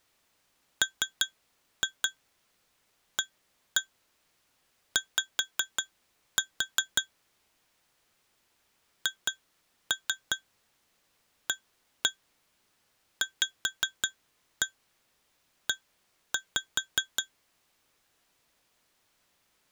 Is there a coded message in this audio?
Yes: tap code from 0.8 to 17.3 s, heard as taps on glass, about 5 knocks a second. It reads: MAY HAVE